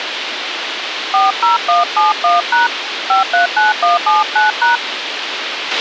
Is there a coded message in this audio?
Yes: DTMF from 1.1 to 4.8 s, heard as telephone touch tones, dialled by hand, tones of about 150 ms, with radio hiss and a squelch burst at the end. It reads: 40171# 539179#